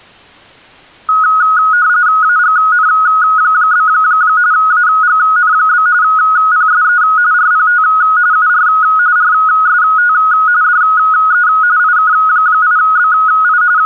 RTTY (45.45 baud, 170 Hz shift), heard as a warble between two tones, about 1360 Hz centre. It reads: AGN? AGN? PSE RPT UR RST DE IK8BI …